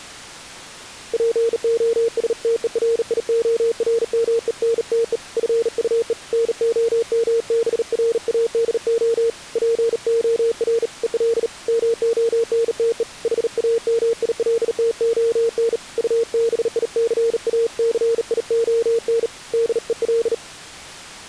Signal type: Morse code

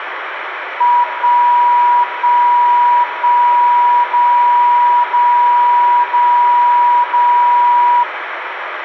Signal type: radio time signal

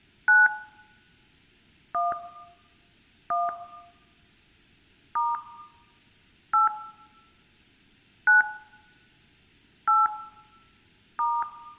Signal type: DTMF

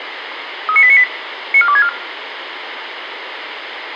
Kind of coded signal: five-tone selective call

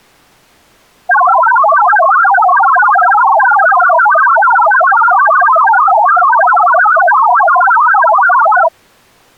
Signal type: multi-tone FSK (Olivia or MFSK type)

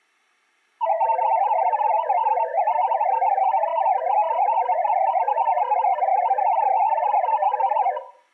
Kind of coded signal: multi-tone FSK (Olivia or MFSK type)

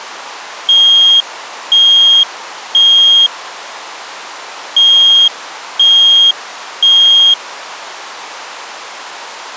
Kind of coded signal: alarm pattern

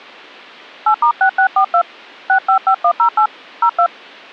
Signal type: DTMF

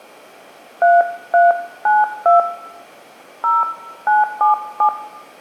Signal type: DTMF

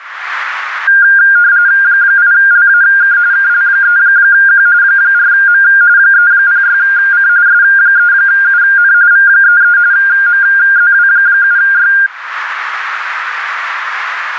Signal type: RTTY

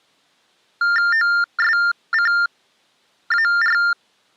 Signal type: TTY/TDD text telephone tones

